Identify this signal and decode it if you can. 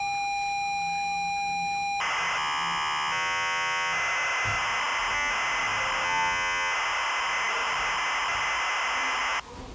ZX Spectrum tape loading, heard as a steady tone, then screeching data, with the noise inside a lift.